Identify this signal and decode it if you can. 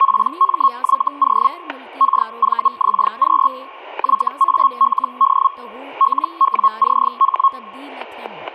Hellschreiber (Feld-Hell, 122.5 baud), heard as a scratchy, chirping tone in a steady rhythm, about 1090 Hz, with static crashes and speech in Sindhi. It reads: PMYO KVXQ YALD LWCH